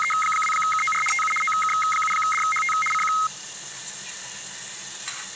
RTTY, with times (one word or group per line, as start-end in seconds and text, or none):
0.0-1.0 …
1.1-1.3 TU
1.4-2.7 OK7DHT
2.9-3.1 CQ